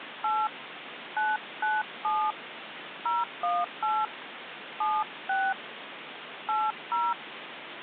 DTMF, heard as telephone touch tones, dialled by hand, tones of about 220 ms, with phone line noise. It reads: 8 997 018 76 80